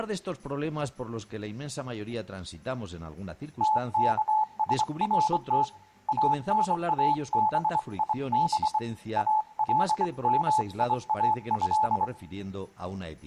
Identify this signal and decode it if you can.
Morse code (Arabic alphabet), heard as a keyed tone, hand-sent with a straight key, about 24 wpm, 860 Hz, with room echo. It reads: تكسرت انابيب المياه